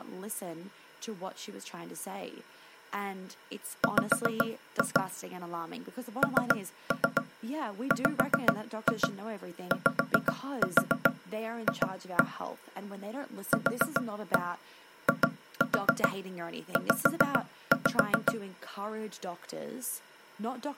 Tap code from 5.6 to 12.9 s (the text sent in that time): NWYF